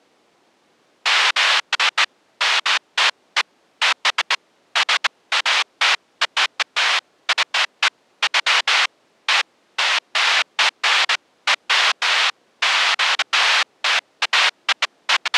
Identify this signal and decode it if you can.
Bursts of noise. There is no code.